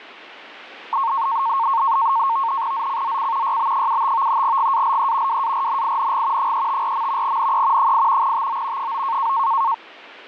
NAVTEX (SITOR-B), 100 baud, 170 Hz shift, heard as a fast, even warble, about 1000 Hz centre. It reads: ZCZC YB75 GALE WARNING 354. NE 8 TO 9